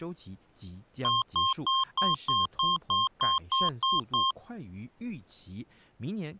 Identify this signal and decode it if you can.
Beep code, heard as beeps from a small speaker, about 1060 Hz, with speech in Chinese. 11 short. In AMI BIOS tables: cache memory error.